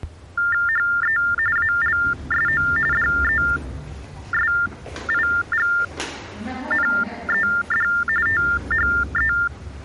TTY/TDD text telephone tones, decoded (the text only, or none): HE ALSO DESIGNED THE